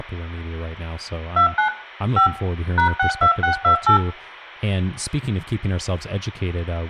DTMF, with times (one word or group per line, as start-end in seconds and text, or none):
1.4-1.7 29
2.2-2.3 5
2.8-4.0 #62628